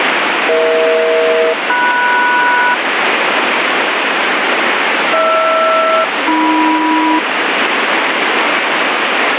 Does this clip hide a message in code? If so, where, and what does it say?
Yes: aircraft SELCAL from 0.5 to 7.2 s, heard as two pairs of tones, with radio static. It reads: EH-MS HR-AM